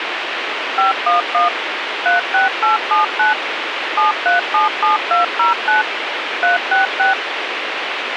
DTMF, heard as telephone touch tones, dialled by machine, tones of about 140 ms, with radio hiss. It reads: 511 36879 7377209 366